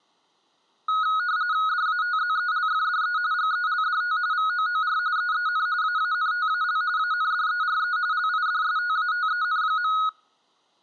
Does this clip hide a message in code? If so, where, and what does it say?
Yes: RTTY (45.45 baud, 170 Hz shift) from 0.9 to 10.1 s, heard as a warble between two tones, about 1360 Hz centre. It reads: DATZELFDE GELDT VOOR EEN AANTAL ANDERE LIDSTATEN.